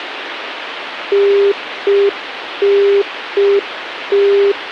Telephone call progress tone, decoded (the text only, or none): congestion tone